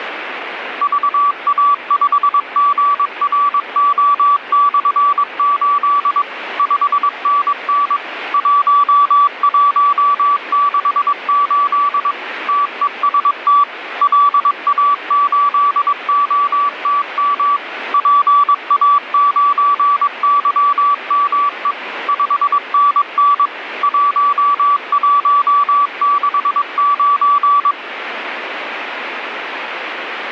Morse code, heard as a keyed tone, machine-sent, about 22 wpm, 1150 Hz, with radio static. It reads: VA5GRO/8 5NN 1168 TEST LA8OTM PA9YME 5NN 1169